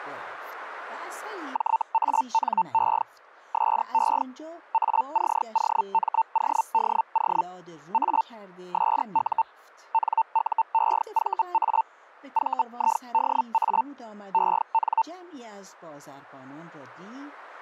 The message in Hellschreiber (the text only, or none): JANE SE ACOMODO A SU NUEVA VIDA EN